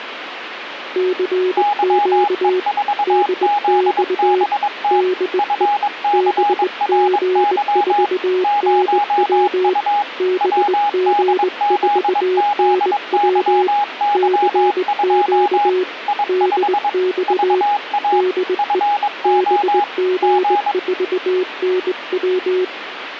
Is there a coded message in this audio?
Yes: Morse code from 0.9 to 22.7 s, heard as two keyed tones, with radio static. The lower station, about 20 wpm, 370 Hz: CQ DX DE BG4NW BG4NW CQ DX DE BG4NW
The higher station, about 22 wpm, 820 Hz: YE4ZBT FCRY 0U WDZZYY2 I5 VA FO G